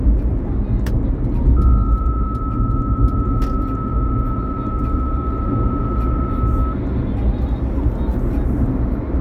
PSK63 (62.5 baud), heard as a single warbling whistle, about 1300 Hz, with the noise inside a car.